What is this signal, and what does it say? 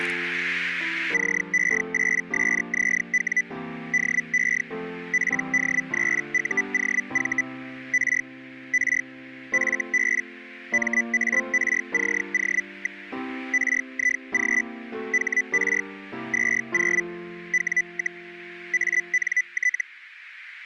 Hellschreiber (Feld-Hell, 122.5 baud), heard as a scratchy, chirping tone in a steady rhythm, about 2000 Hz, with radio static. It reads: CE8SZW DE PD3UOV R R FB MARCO. RIG HR 20 W, ANT